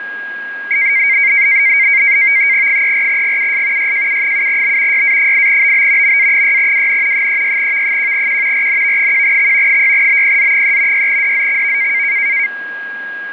NAVTEX (SITOR-B), 100 baud, 170 Hz shift, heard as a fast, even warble, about 2200 Hz centre, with a steady whistle near 1640 Hz. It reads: 34GUS YJU7B YA8BB MA6WN 36V1Q RNV1X 6BPZ3 6DZXV